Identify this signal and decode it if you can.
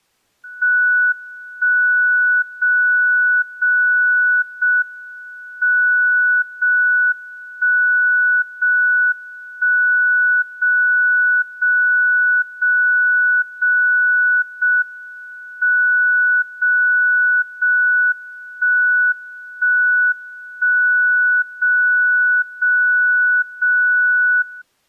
Radio time signal (JJY), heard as a tone whose level steps once a second, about 1480 Hz. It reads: 1 0 0 0 M 0 1 0 1 0 0 0 0 0 M 0 0 1 1 1 0 0 0 0